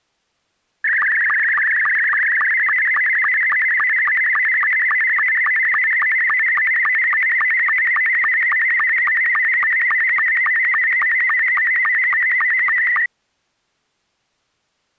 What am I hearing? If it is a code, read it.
SSTV (slow-scan television), Scottie S2, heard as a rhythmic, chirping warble.